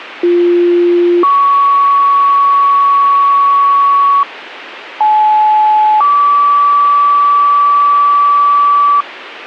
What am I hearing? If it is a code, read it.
Two-tone page, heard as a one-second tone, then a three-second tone, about 350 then 1120 Hz, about 860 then 1150 Hz, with radio hiss.